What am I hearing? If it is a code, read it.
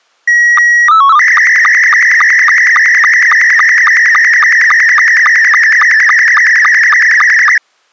SSTV (slow-scan television), Scottie S2, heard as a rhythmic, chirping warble.